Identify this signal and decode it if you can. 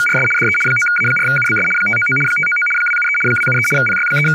RTTY (75 baud, 850 Hz shift), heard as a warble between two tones, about 1850 Hz centre, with speech in English. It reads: … DE 9A4UBS 599 599 273 273 …